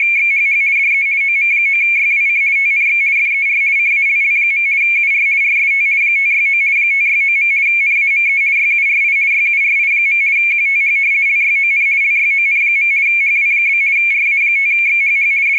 RTTY (50 baud, 170 Hz shift), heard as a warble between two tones, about 2300 Hz centre, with radio static and static crashes. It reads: … DE OM9YWC TNX FER CALL. UR RST 569 569. NAME YURI YURI. QTH LYON LYON. HW? RA5XHH …